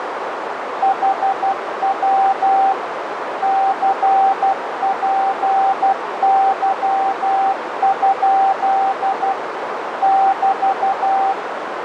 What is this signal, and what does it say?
Morse code, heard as a keyed tone, machine-sent, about 12 wpm, 780 Hz, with radio static and a narrow filter. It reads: HW CPY? <BT>